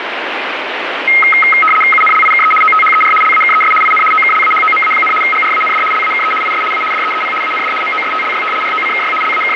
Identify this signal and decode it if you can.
RTTY (75 baud, 850 Hz shift), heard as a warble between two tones, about 1700 Hz centre, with radio static. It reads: UNLIKE OTHER LAKES IN OKLAHOMA, GRAND LAKE IS A DEEP AND MOSTLY ROCKY …